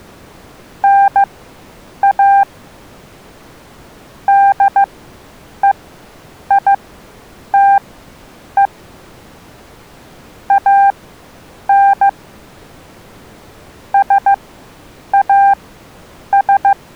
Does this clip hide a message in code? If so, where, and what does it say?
Yes: Morse code (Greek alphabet) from 0.8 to 16.8 s, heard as a keyed tone, machine-sent, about 15 wpm, spaced as for 8 wpm, 790 Hz. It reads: ΝΑ ΔΕΙΤΕ ΑΝ ΣΑΣ